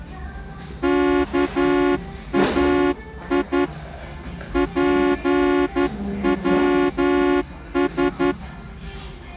Morse code (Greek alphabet), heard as a horn, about 11 wpm, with the noise of a restaurant. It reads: ΚΑΙ ΠΩΣ